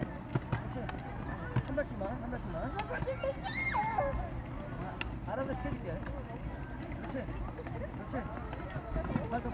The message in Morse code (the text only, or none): none